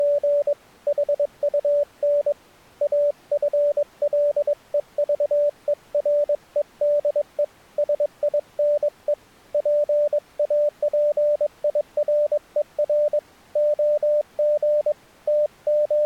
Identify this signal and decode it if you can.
Morse code, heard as a keyed tone, hand-sent with a paddle, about 22 wpm, 590 Hz. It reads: … HUN AFLEVEREDE SINE PAPIRER OG …